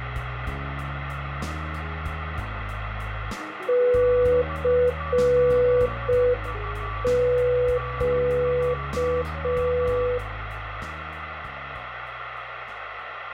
Morse code, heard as a keyed tone, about 5 wpm, 490 Hz, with radio static and a weaker station near 1150 Hz. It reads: CQ